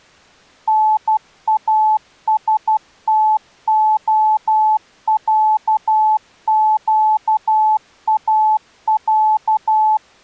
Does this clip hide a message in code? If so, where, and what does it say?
Yes: Morse code (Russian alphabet) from 0.6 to 10.0 s, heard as a keyed tone, machine-sent, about 12 wpm, 860 Hz. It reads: НАСТОЯЩАЯ